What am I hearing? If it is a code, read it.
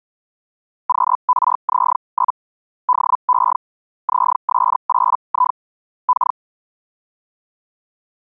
Hellschreiber (Feld-Hell, 122.5 baud), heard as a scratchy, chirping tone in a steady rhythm, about 1000 Hz. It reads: QRZ? DE ZS8I K